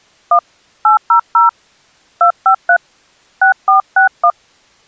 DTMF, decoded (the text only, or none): 1 800 253 6461